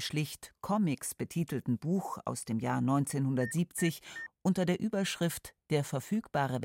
Beep code, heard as beeps, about 1800 Hz, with speech in German. 3 short. In AMI BIOS tables: failure in the first 64 KB of memory; in Dell tables: chipset error.